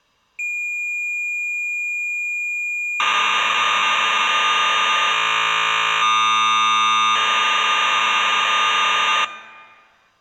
Cassette data (Kansas City type), 1200 baud, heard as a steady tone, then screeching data.